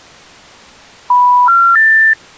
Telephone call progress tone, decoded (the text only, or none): special information tone